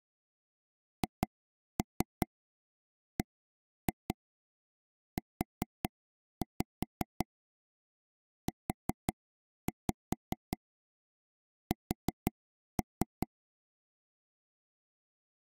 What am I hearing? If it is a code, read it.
Tap code, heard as taps on a table, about 5 knocks a second. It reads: HBUUS